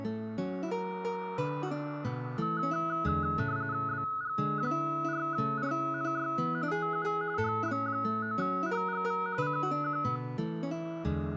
RTTY (45.45 baud, 170 Hz shift), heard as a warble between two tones, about 1370 Hz centre. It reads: BG4RNY TU HB9HGV CQ